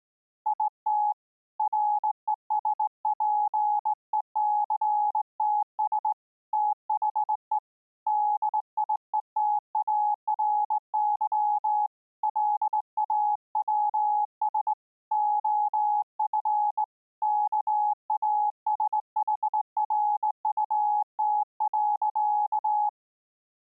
Morse code, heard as a keyed tone, hand-sent with a straight key, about 19 wpm, 840 Hz. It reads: IT RESPECTS THE DIETARY LAWS OF KASHRUT.